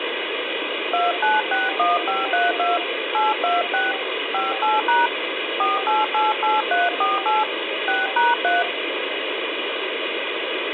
DTMF, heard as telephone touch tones, dialled by hand, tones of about 180 ms, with phone line noise. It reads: 2961532 826 58# 4888348 6#3